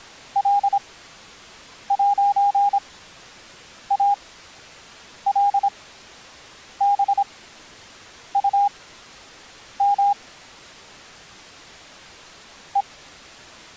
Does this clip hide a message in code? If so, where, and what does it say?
Yes: Morse code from 0.3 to 12.9 s, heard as a keyed tone, machine-sent, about 26 wpm, spaced as for 7 wpm, 810 Hz. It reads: L'ALBUM E